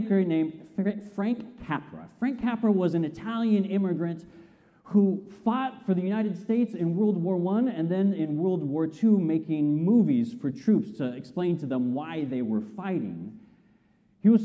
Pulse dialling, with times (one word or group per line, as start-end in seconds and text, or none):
none